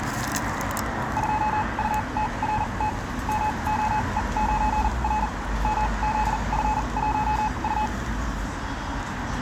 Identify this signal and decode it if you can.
Morse code, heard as a keyed tone, machine-sent, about 40 wpm, spaced as for 30 wpm, 860 Hz, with room echo and street noise. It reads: 2UTRT MOE9R MZF1U